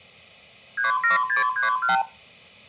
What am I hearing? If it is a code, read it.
Multi-frequency trunk signalling (R2, with the far end's replies), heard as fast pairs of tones, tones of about 130 ms, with room echo. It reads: 37631